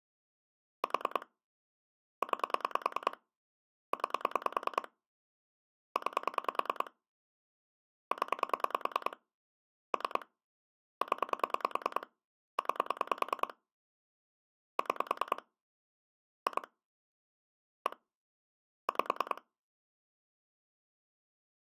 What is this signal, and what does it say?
Pulse dialling, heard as clicks on a phone line, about 10 pulses a second. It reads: 4 9 9 9 0 3 0 9 6 2 1 5